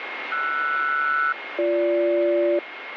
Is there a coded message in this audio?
Yes: aircraft SELCAL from 0.3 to 2.6 s, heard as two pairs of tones, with radio static and a steady whistle near 2150 Hz. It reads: RS-BG